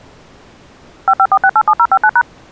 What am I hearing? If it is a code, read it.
DTMF, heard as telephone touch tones, dialled by machine, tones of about 60 ms. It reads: 554687059#